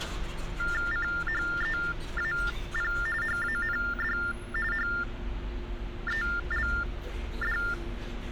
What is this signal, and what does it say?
TTY/TDD text telephone tones (45.45 baud Baudot), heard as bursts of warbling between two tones, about 400 Hz shift, 1600 Hz centre, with hum and street noise. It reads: CHEAP HAND HELD